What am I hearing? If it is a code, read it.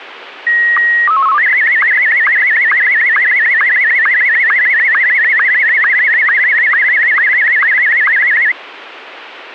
SSTV (slow-scan television), Martin M1, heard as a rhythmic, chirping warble, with radio hiss.